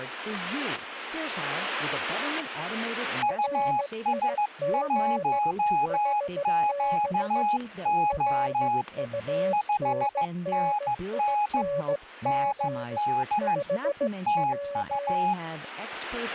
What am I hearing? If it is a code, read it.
Morse code, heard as two keyed tones, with static crashes and speech in English. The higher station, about 15 wpm, 830 Hz: US1QO 5NN ND TU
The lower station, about 16 wpm, 570 Hz: RIG HB RUNNING 5W